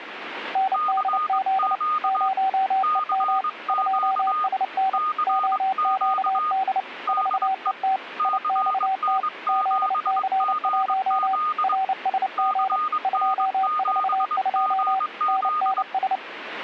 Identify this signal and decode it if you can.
Morse code, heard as two keyed tones, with radio static. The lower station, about 29 wpm, 770 Hz: NDZ 0EM 2SN OQD 4ET IXT ZC1 RSG 242 NNS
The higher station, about 22 wpm, 1230 Hz: CQ CQ CQ DE CN7GZ CN7GZ